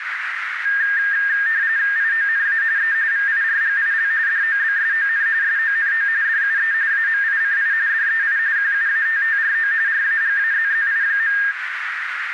RTTY (45.45 baud, 170 Hz shift), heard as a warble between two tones, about 1700 Hz centre, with radio static and a narrow filter. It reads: IONA E VIRGIL DOBSON SONO DUE AMICI DEI QUATTRO RAGAZZI.